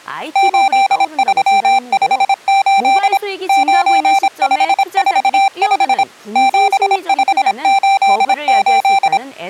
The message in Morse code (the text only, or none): 8358 9545 7588